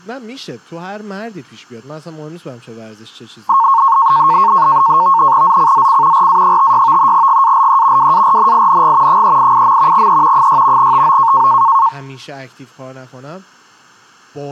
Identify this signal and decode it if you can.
NAVTEX (SITOR-B), 100 baud, 170 Hz shift, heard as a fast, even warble, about 1000 Hz centre, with speech in Persian. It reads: ZCZC RA56 GALE WARNING 388. E 6 TO